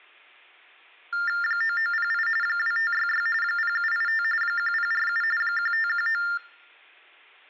TTY/TDD text telephone tones (45.45 baud Baudot), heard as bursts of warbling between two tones, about 400 Hz shift, 1600 Hz centre, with room echo. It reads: 9908 2566 0785 1047 1519